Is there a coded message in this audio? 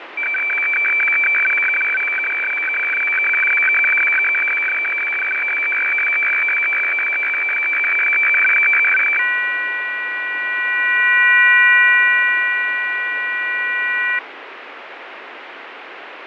Yes: weather fax (radiofax), 120 lines a minute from 0.2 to 14.2 s, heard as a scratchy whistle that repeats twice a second, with radio static and fading.